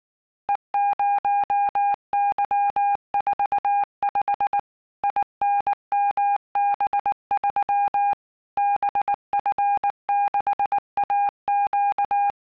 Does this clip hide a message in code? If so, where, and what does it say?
Yes: Morse code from 0.4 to 12.4 s, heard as a keyed tone, machine-sent, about 19 wpm, 810 Hz. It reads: E0Y45 INMB3 BF6AQ